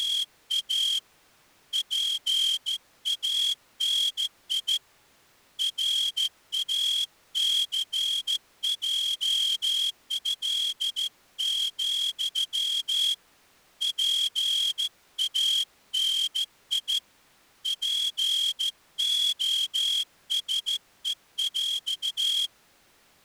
Morse code (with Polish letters), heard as a whistle, hand-sent with a straight key, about 14 wpm. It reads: … PANI RACJĘ, PANI POSEŁ